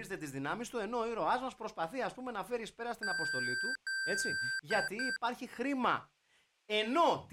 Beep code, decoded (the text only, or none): 2 long, 2 short